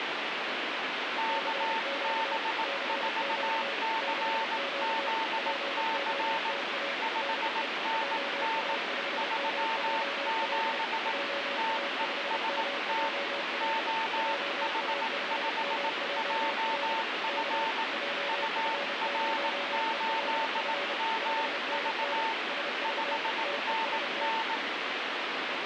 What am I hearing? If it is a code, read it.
Morse code, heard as two keyed tones, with heavy radio static. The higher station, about 18 wpm, 900 Hz: KB4CZC 5NN 37 TEST OH5JF UR8MV 5NN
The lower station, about 30 wpm, 560 Hz: CQ CQ CQ POTA DE JA5MJL JA5MJL JA5MJL K JF0ELF 5NN SV TEST